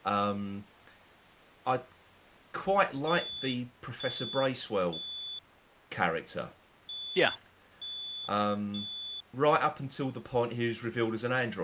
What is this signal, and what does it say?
Alarm pattern, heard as an alarm's beeps, played twice, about 3450 Hz, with speech in English. Temporal three. Smoke or fire, evacuate.